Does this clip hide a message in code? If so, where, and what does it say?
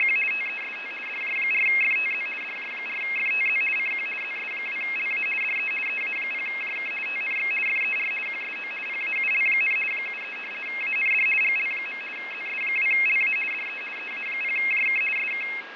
Yes: RTTY (50 baud, 450 Hz shift) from 0.0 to 15.6 s, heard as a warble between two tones, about 2350 Hz centre, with radio static, fading and a steady whistle near 1640 Hz. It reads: … TEST DJ4FTZ DJ4FTZ CQ ZS2LA DE EA0JK TNX FER QSO PAUL, 73 AND GL. ZS2LA DE EA0JK SK